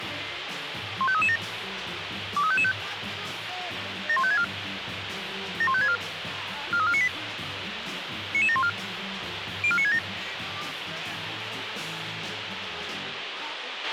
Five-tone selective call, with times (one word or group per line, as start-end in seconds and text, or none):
1.0-1.4 15337
2.4-2.7 23555
4.1-4.4 71564
5.6-6.0 71564
6.7-7.1 43498
8.3-8.7 99714
9.6-10.0 04967